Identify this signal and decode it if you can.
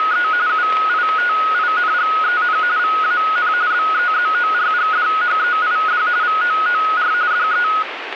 RTTY (45.45 baud, 170 Hz shift), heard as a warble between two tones, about 1360 Hz centre, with radio static. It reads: … UITINGEN VAN BEZORGDHEID VOOR DE